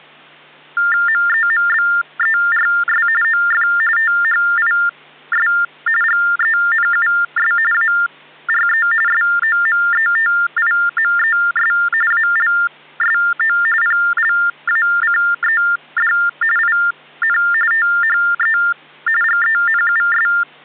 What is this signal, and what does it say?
TTY/TDD text telephone tones (45.45 baud Baudot), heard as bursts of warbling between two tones, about 400 Hz shift, 1600 Hz centre. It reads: MEMBERS OF THIS GENUS ARE SOMETIMES ALSO PLACED IN THE GENUS